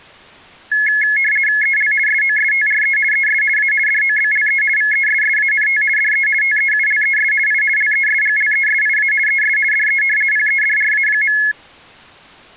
RTTY (50 baud, 450 Hz shift), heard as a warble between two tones, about 1950 Hz centre. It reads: EL SOSTRE ES A DOBLE VESSANT DE TEULES I LESGLESIA ES DE PEDRA.